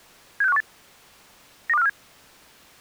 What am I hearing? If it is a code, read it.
Five-tone selective call (EEA), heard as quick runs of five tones, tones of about 40 ms. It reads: 76518 92547